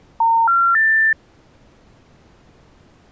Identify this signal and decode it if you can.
Telephone call progress tone (North American plan), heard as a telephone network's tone, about 910, 1370, 1800 Hz. Special information tone.